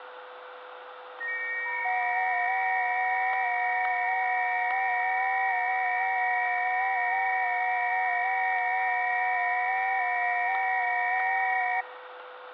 FT8 (several signals at once), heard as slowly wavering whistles, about 6.25 baud, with radio static, static crashes and a steady whistle near 500 Hz.